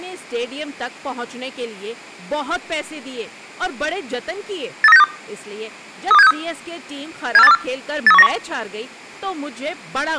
Five-tone selective call (EEA), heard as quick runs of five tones, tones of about 40 ms, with speech in Urdu. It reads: 83962 32763 74824 83191